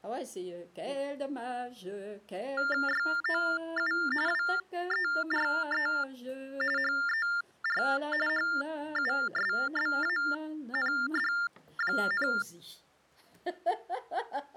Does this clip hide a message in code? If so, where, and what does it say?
Yes: TTY/TDD text telephone tones (45.45 baud Baudot) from 2.6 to 12.4 s, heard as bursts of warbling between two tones, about 400 Hz shift, 1600 Hz centre. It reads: YOU WERE HER HUSBAND,